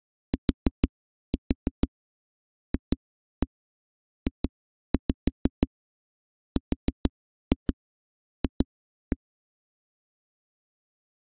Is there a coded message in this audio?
Yes: tap code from 0.3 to 9.2 s, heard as knocks on a wall, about 6 knocks a second. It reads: TFJRF